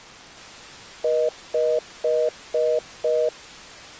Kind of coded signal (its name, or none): telephone call progress tone